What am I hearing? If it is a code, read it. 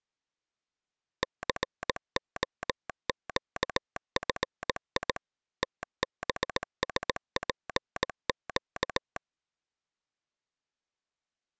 Morse code, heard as a telegraph sounder, machine-sent, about 18 wpm. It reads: COQFI TBSPQ